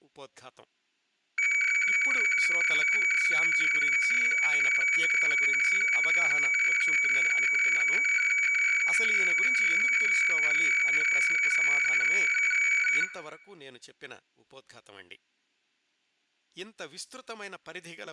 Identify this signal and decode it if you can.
Weather fax (radiofax), 120 lines a minute, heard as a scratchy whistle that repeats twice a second, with room echo and speech in Tamil.